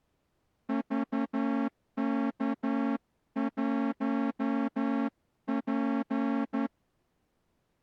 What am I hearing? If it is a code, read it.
Morse code, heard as a horn, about 11 wpm. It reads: VK1P